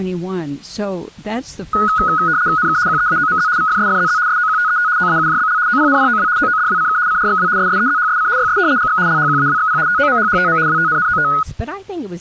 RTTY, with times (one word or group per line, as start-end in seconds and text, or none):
2.6-2.8 NK
2.9-3.5 QEAOMZ
3.6-4.2 VFSFZZ
4.3-4.9 SOQTET
5.0-5.6 OAUJBL
5.7-6.3 OPNPOW
6.4-7.0 OODWCK
7.1-7.5 CRXW
7.6-8.3 SSEZHSC
8.4-8.6 YS
8.8-9.0 GX
9.1-9.8 LHQAWXP
9.9-10.6 TOMHHTM
10.7-11.3 WTNNOT